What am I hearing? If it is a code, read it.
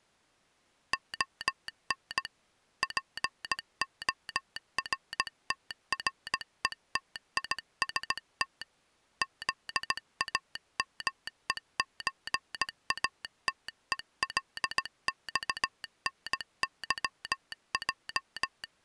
Morse code (Russian alphabet), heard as a telegraph sounder, hand-sent with a paddle, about 17 wpm. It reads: ОН ПОРТРЕТИСТ ЗАМЕЧАТЕЛЬНЫЙ